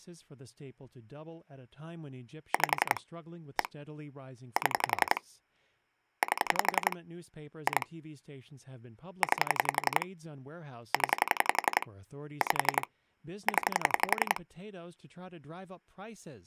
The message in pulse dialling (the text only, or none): 5 1 7 8 2 9 0 5 0